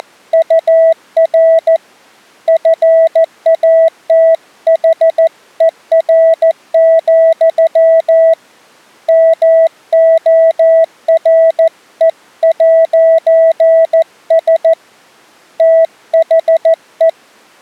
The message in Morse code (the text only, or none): … FATHER, MORE'S THE